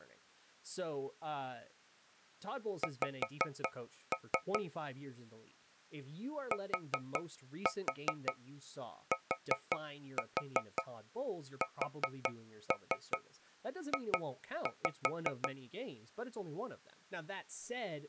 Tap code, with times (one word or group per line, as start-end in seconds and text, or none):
2.8-4.6 X
6.5-15.5 TTSJ